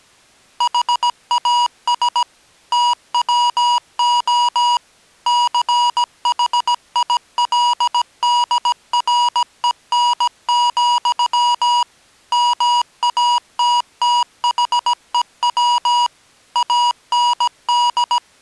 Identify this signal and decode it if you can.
Morse code, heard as electronic beeps, machine-sent, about 17 wpm, 960 Hz. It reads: HAS TWO CHILDREN, MATTHEW AND